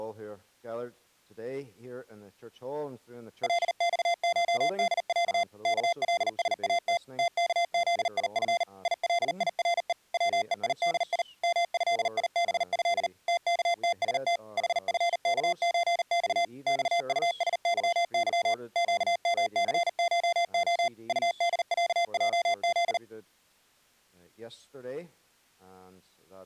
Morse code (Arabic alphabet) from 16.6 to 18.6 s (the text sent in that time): صطسظظ